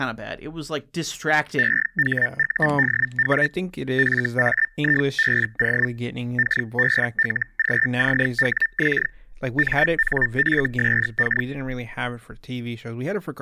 Hellschreiber (Feld-Hell, 122.5 baud), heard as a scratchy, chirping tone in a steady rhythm, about 1800 Hz, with speech in English. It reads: EHUDW FAIBO KBLGCWX MNFSK